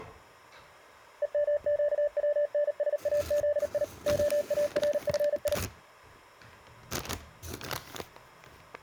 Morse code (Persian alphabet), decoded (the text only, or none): همگونسازی عارفی